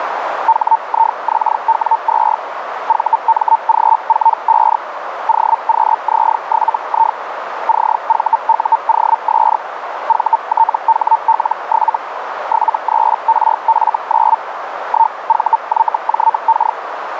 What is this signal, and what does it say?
Hellschreiber (Feld-Hell, 122.5 baud), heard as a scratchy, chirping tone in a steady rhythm, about 900 Hz, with radio static and a narrow filter. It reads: HIXW2 VMG45 OQZ7I CVUOS VTHL7 73RF9 1VYJK